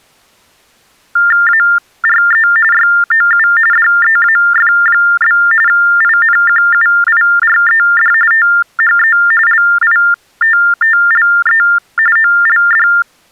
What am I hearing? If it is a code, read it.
TTY/TDD text telephone tones (45.45 baud Baudot), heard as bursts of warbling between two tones, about 400 Hz shift, 1600 Hz centre. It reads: ARE YOU DEAF? INQUIRED THE LITTLE OLD